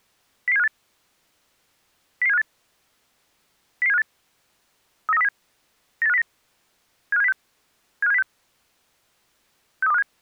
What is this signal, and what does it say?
Five-tone selective call (EEA), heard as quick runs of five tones, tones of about 40 ms. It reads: 00758 00758 00758 39307 98509 75706 75706 63257